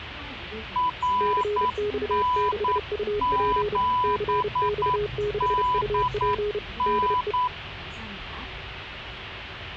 Morse code, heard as two keyed tones, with radio static and the noise inside a bus. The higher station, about 9 wpm, 1000 Hz: RN7DN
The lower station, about 31 wpm, 420 Hz: CX6UP CX6UP DE